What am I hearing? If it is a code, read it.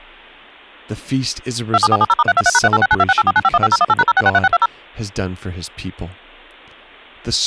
DTMF, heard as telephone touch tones, dialled by machine, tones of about 40 ms, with speech in English. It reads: 27470*323#386926849515018#0663620